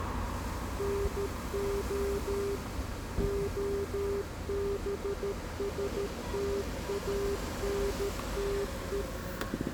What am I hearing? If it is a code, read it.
Morse code, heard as a keyed tone, machine-sent, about 13 wpm, 400 Hz, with street noise. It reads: NO OBSTANTE